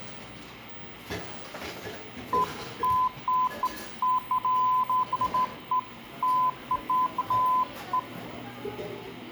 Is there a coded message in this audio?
No, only beeps of irregular length, with the noise of a cafe.